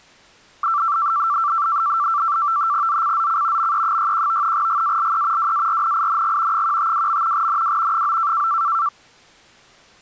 NAVTEX (SITOR-B), 100 baud, 170 Hz shift, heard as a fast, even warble, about 1250 Hz centre. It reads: ZCZC ME61 GALE WARNING 152. NW 9